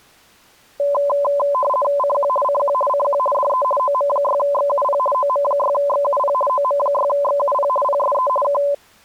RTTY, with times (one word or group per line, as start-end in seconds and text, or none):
2.0-2.3 CQ
2.4-2.7 CQ
2.9-3.2 CQ
3.3-3.6 DE
3.8-5.0 OM6XUP
5.1-6.3 OM6XUP
6.5-7.7 OM6XUP
7.8-8.3 PSE
8.4-8.6 K